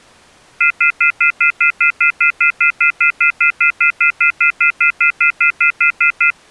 Telephone call progress tone (North American plan), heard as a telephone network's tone, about 1400, 2050, 2450, 2600 Hz, 0.1 s on and 0.1 s off. Off-hook warning tone.